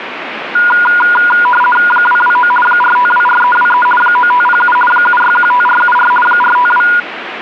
RTTY (50 baud, 450 Hz shift), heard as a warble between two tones, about 1210 Hz centre, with radio static. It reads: 229 4524323 9507 7615474 452